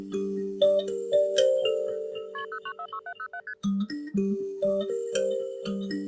Multi-frequency trunk signalling (R1, as on North American trunks), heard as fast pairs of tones, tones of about 70 ms. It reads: KP 0946707 ST